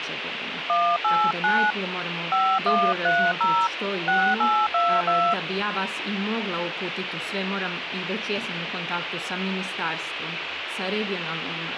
DTMF, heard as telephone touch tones, dialled by hand, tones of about 270 ms, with phone line noise. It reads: 189 5130 6822